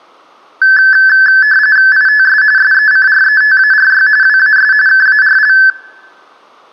RTTY (45.45 baud, 170 Hz shift), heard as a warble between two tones, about 1650 Hz centre, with room echo. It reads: ITS SECRETARY WAS KARL